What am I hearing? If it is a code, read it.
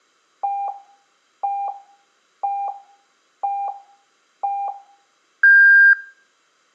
Radio time signal (five pips and a higher one, as on Chinese radio), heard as pips.